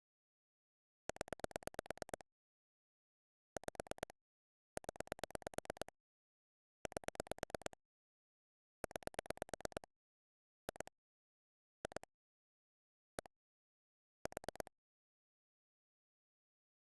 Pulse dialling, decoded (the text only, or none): 0 5 0 8 9 2 2 1 4